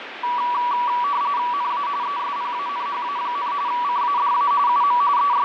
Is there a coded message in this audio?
Yes: RTTY (45.45 baud, 170 Hz shift) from 0.2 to 5.4 s, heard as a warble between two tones, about 1060 Hz centre, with radio static and fading. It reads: NA ESPANHA, CADA UM …